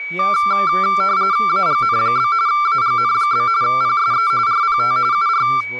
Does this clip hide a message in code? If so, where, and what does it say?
Yes: RTTY (45.45 baud, 170 Hz shift) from 0.2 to 5.6 s, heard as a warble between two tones, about 1270 Hz centre, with a steady whistle near 2270 Hz and speech in English. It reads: AGN? AGN? PSE RPT UR